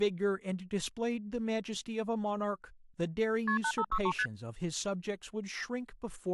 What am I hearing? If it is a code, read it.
Multi-frequency trunk signalling (R1, as on North American trunks), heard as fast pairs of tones, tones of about 70 ms, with speech in English. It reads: KP 8563 ST